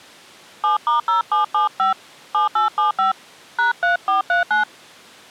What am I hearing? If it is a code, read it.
DTMF, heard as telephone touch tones, dialled by hand, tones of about 130 ms. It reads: 7*0775 7875 #3439